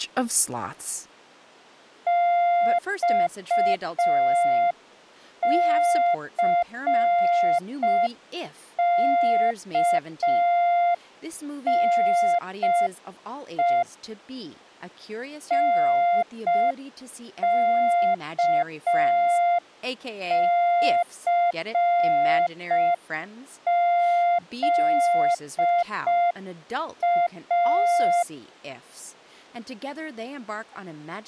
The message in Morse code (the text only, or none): XCKNE NKCZA